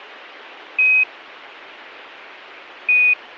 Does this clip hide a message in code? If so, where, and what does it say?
Yes: Quindar tones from 0.8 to 3.1 s, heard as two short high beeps.